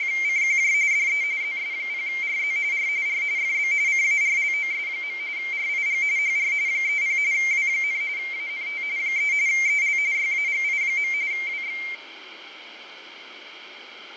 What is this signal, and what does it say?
RTTY (45.45 baud, 170 Hz shift), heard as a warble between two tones, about 2200 Hz centre, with radio static, fading and room echo. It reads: … DE ZS0RZ R R FB CARLOS. RIG HR 30 W, ANT 3 EL YAGI. WX